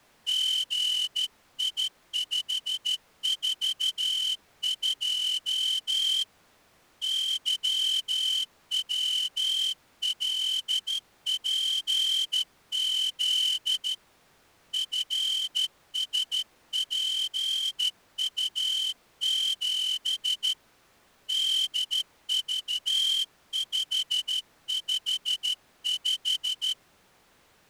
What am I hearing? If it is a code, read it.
Morse code, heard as a whistle, hand-sent with a straight key, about 13 wpm. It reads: GI542 YWLPZ FSPU7 DV555